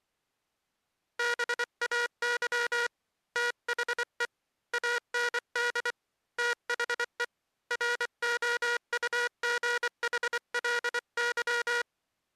Morse code, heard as a buzzer, hand-sent with a paddle, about 24 wpm. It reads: BAY THE AND THE ROUGHLY